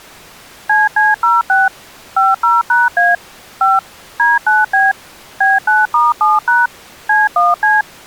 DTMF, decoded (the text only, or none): CC06 50#A 5 D9B B9*7# C1C